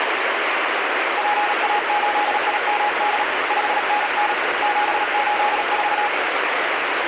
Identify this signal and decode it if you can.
Morse code, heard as a keyed tone, hand-sent with a paddle, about 37 wpm, 830 Hz, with heavy radio static. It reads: PA8IMD 5NN 784